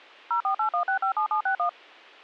DTMF, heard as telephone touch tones, dialled by machine, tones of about 100 ms. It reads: 0481657761